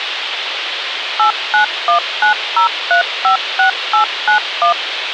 DTMF, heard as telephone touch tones, dialled by machine, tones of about 110 ms, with radio hiss. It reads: 89190356891